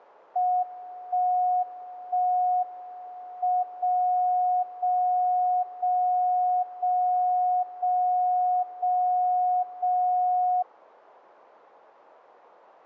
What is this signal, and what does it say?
Radio time signal (WWVB), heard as a tone whose level steps once a second, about 730 Hz. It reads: 1 1 M 0 0 0 0 0 0 0